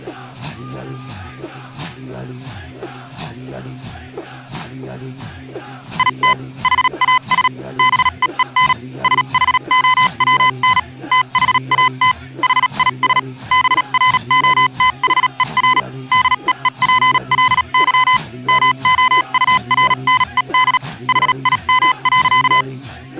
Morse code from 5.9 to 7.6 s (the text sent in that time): IT HAS